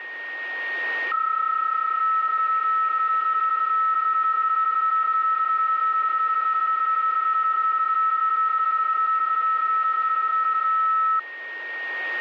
PSK31 (31.25 baud), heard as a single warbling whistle, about 1300 Hz, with a steady whistle near 1860 Hz.